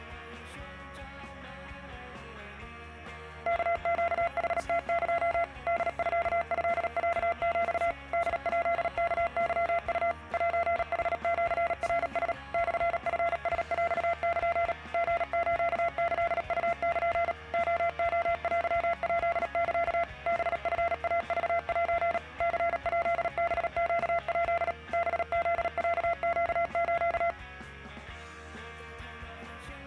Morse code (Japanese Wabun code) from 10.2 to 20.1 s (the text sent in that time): セヌシナラ モチラヰル リスキウル レレテヱサ